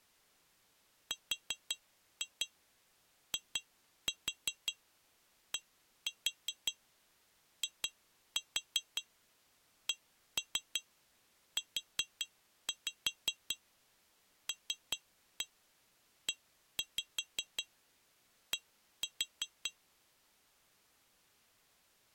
Tap code, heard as taps on glass, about 5 knocks a second. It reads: RIDICULED